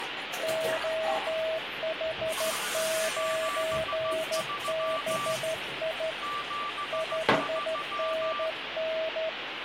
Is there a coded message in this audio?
Yes: Morse code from 0.4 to 9.4 s, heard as two keyed tones, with radio static and kitchen noise. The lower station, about 13 wpm, 640 Hz: OH9BI 5NN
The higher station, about 15 wpm, 1170 Hz: 73 73